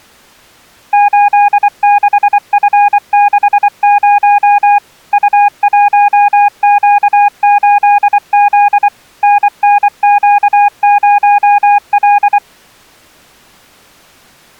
Morse code, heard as a keyed tone, machine-sent, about 24 wpm, 820 Hz. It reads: 86F60 U1Q8Z NNQ0L